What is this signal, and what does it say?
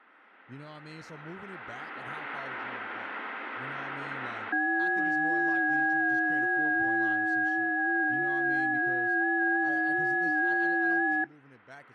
FT8 (several signals at once), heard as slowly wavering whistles, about 6.25 baud, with speech in English.